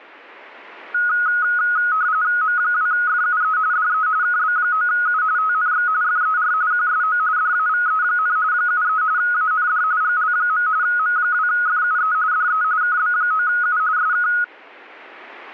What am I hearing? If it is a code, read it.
RTTY (45.45 baud, 170 Hz shift), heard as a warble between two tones, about 1360 Hz centre. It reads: M2FUE DE KB9U TNX FER QSO DAVE, 73 AND GL. M2FUE DE KB9U SK